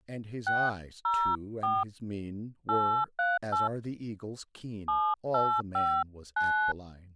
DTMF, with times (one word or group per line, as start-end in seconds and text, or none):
0.5-1.8 604
2.7-3.7 838
4.9-6.7 7859